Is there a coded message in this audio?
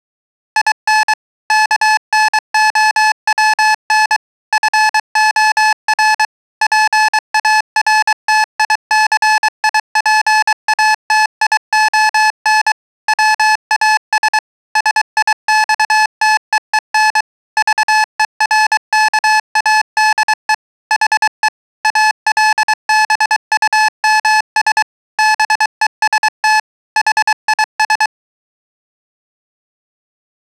Yes: Morse code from 0.5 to 28.1 s, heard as electronic beeps, machine-sent, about 23 wpm, 860 Hz. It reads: IN KNOWN FOR PARTICIPATION WAS SIXTEEN VERKADE HE ALBUMS BEST HIS